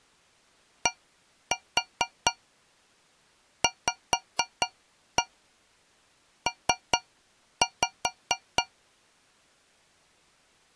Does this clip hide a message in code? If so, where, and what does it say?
Yes: tap code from 0.9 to 8.7 s, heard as taps on a metal pipe, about 4 knocks a second. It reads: DVP